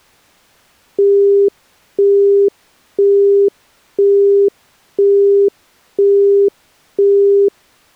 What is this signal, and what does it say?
Telephone call progress tone (single-tone plan, as in Europe, Japan and elsewhere), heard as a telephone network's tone, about 400 Hz, 0.5 s on and 0.5 s off. Busy tone.